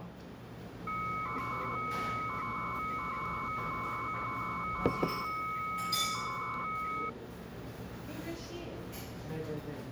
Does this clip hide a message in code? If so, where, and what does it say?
Yes: 300-baud modem data (Bell 103 tones) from 0.9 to 7.1 s, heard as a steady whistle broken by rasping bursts, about 300 baud, 200 Hz shift, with the noise of a restaurant.